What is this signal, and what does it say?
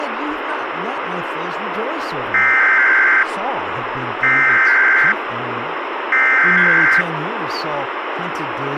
Emergency Alert System (SAME) tones (header bursts), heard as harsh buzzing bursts, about 520.83 baud, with radio hiss and speech in English.